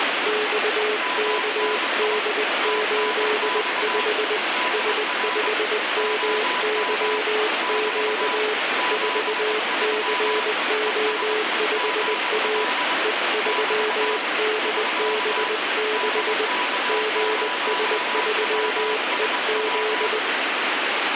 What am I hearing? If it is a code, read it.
Morse code, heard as two keyed tones, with heavy radio static. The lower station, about 20 wpm, 430 Hz: XKD85 S5MYQ 4CO5A E3DB6 GS3EZ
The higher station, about 22 wpm, 990 Hz: MNI TNX DR OM <BT> 73 ES GL <BT> <SK> DK0WSW